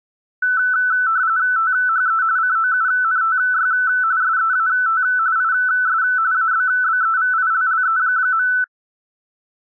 RTTY (45.45 baud, 170 Hz shift), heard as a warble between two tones, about 1410 Hz centre. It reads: THE COUNTY SEAT IS ABBEVILLE.